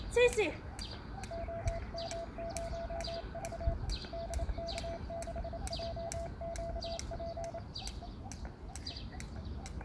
Morse code, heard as a keyed tone, hand-sent with a paddle, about 28 wpm, 670 Hz, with the noise of a park. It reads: OM0V DK6JQP